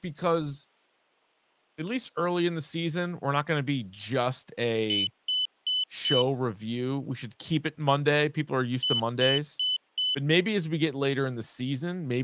Beep code, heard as a piezo beeper, played twice, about 3000 Hz, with speech in English. 4 short. In AMI BIOS tables: system timer failure; in Dell tables: memory read or write failure.